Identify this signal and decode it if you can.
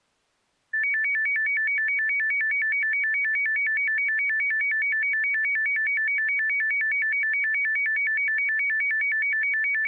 A tone that alternates evenly between two pitches. There is no code.